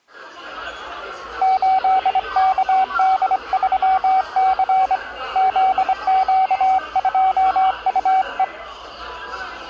Morse code, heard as a keyed tone, hand-sent with a straight key, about 24 wpm, 760 Hz, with the noise of a cafe. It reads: 8KD3C ZQ2UE